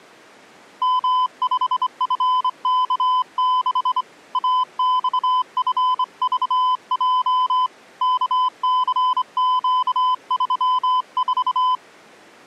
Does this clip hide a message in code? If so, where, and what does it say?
Yes: Morse code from 0.8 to 11.8 s, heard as a keyed tone, hand-sent with a straight key, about 25 wpm, 1010 Hz. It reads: M5FK6 AXFVJ KCQ34